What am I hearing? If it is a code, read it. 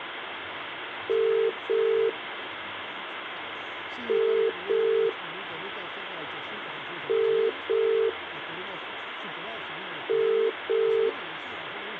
Telephone call progress tone (as in the UK, Ireland, Australia and similar networks), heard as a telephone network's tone, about 400, 450 Hz, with phone line noise. Ringback tone.